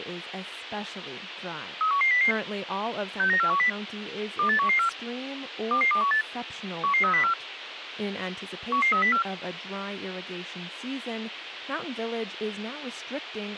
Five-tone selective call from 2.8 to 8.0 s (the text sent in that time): 69410 28114 22218 11304